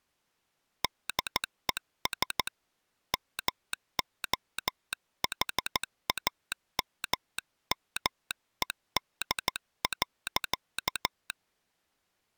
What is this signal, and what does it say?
Morse code, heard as a telegraph sounder, hand-sent with a paddle, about 14 wpm. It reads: DES MOHAMMED.